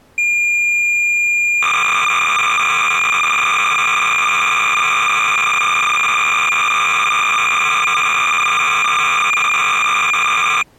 Cassette data (Kansas City type), 300 baud, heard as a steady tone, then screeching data.